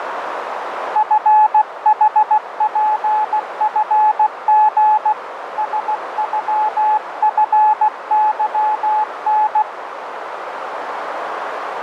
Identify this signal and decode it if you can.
Morse code (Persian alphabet), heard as a keyed tone, hand-sent with a paddle, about 16 wpm, 860 Hz, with radio static and a narrow filter. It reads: فحپفژ سغفظن